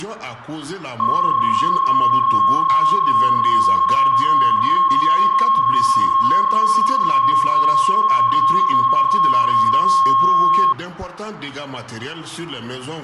PSK31 (31.25 baud), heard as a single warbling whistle, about 1080 Hz.